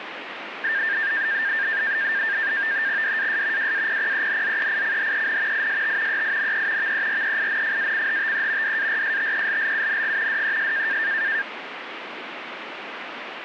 NAVTEX (SITOR-B), 100 baud, 170 Hz shift, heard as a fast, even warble, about 1700 Hz centre, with radio static. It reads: DAS WAPPENZEICHEN IST EINE VEREINFACHTE DARSTELLUNG DES